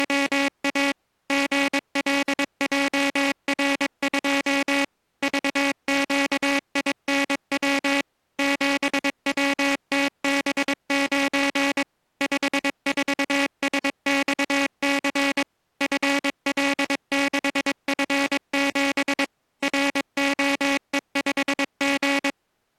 Morse code, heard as a buzzer, machine-sent, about 22 wpm. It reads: … GLJR2 VQINW 7WTB9 54SXC FL6F7 ROE5G